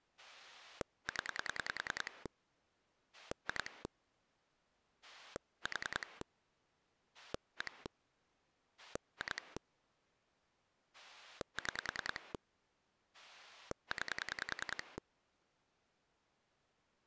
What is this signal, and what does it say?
Pulse dialling, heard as a rotary dial, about 10 pulses a second. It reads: 0 2 4 1 2 6 9